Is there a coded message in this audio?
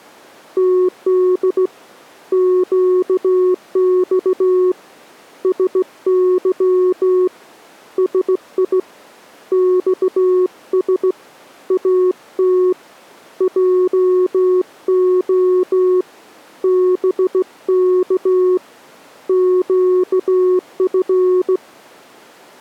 Yes: Morse code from 0.5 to 21.6 s, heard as a keyed tone, hand-sent with a straight key, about 16 wpm, 370 Hz. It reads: TD QX SY SI XS AT JO BK QF